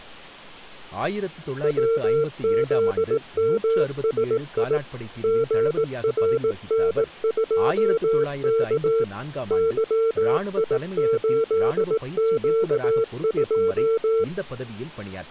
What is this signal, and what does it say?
Morse code, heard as a keyed tone, machine-sent, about 18 wpm, 450 Hz, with speech in Tamil. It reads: WZMSI GRN2K YI8Q2